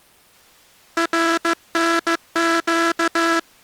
Morse code (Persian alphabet), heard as a buzzer, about 15 wpm. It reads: رنگ